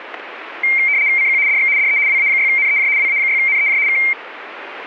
RTTY (75 baud, 170 Hz shift), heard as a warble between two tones, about 2200 Hz centre, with radio static. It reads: CQ DX DE WA6NEJ WA6NEJ K